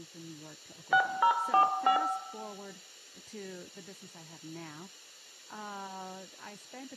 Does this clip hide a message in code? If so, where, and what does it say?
Yes: DTMF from 0.9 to 2.0 s, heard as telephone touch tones, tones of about 90 ms, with room echo and speech in English. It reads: 6045